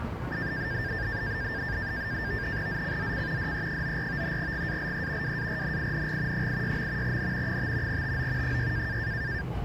NAVTEX (SITOR-B), 100 baud, 170 Hz shift, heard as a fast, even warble, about 1700 Hz centre, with the noise of a residential street. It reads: ZCZC DE94 GALE WARNING 86. N 5 TO 6